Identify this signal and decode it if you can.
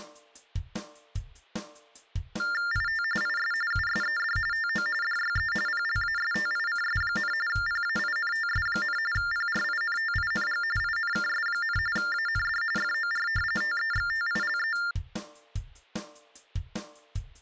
TTY/TDD text telephone tones (45.45 baud Baudot), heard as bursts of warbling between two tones, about 400 Hz shift, 1600 Hz centre. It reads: IT IS USED TO DYE PLASTICS, PAINTS, PRINTING INKS, AND FOR TEXTILE